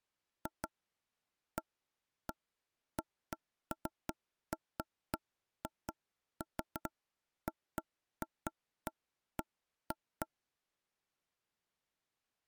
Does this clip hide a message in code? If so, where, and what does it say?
No, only irregular taps on a table.